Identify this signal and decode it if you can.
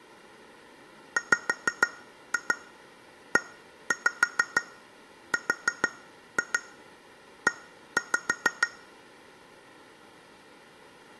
Tap code, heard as taps on glass, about 6 knocks a second. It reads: WERE